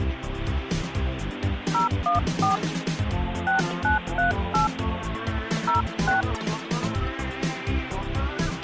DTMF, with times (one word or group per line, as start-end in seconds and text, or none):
1.7-2.6 014
3.5-4.7 6938
5.7-6.2 06